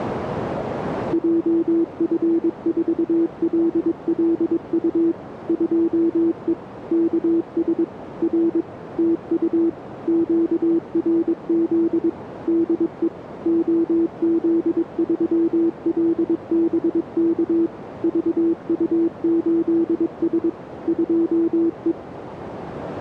Morse code, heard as a keyed tone, machine-sent, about 22 wpm, 330 Hz, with radio static and a narrow filter. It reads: JF4LLU 2E KS R TU QRZ DE OZ3LBK VU8S 2E